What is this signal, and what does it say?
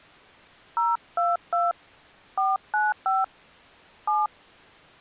DTMF, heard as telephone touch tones, dialled by hand, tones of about 190 ms. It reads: 022 495 7